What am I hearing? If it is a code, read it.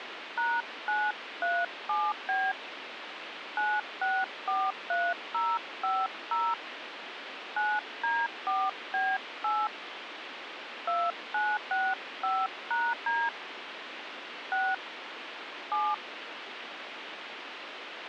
DTMF, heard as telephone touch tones, dialled by hand, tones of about 230 ms, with radio hiss. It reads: #937B 9643050 9D4B8 2965#D 6 7